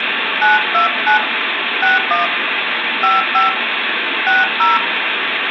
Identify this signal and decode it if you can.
DTMF, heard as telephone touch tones, dialled by hand, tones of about 140 ms, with phone line noise and room echo. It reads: 929 61 55 60